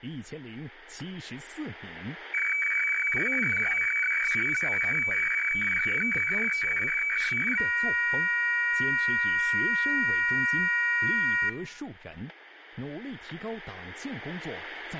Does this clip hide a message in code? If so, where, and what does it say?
Yes: weather fax (radiofax), 120 lines a minute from 2.3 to 11.5 s, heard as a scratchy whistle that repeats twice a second, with room echo.